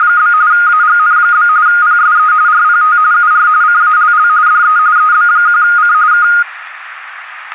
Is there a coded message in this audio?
Yes: RTTY (45.45 baud, 170 Hz shift) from 0.0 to 6.4 s, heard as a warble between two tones, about 1340 Hz centre, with radio static. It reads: … AGN? PSE RPT UR CALL DE EB1C K